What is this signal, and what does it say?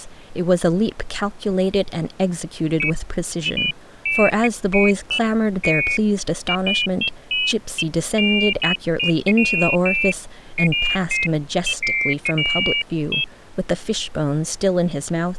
Pairs of high tones at irregular times, with speech in English. There is no code.